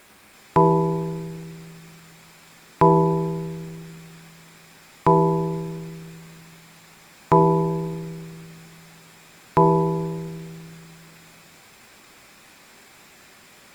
Clock strike, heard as a bell, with room echo. 5. Five o'clock.